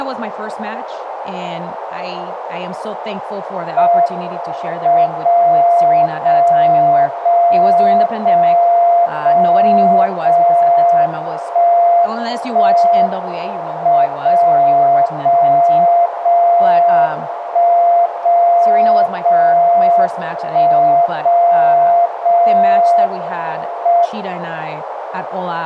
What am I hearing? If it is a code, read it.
Radio time signal (WWVB), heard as a tone whose level steps once a second, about 690 Hz, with radio static, a narrow filter and speech in English. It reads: M 0 0 0 0 0 0 1 1 M 0 0 0 1 0 0 1 0 0 M